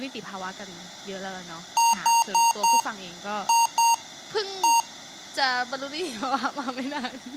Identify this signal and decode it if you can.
Beep code, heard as beeps from a small speaker, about 930 Hz, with speech in Thai. 4-2-1. In Phoenix BIOS tables: timer tick failure.